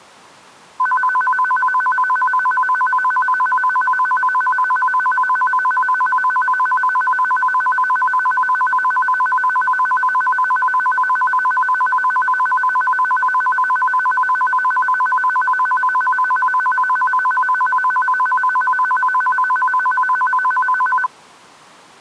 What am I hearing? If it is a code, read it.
A tone that alternates evenly between two pitches. There is no code.